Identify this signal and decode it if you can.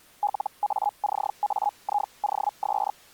Hellschreiber (Feld-Hell, 122.5 baud), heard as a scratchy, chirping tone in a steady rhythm, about 830 Hz. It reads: LACAIOS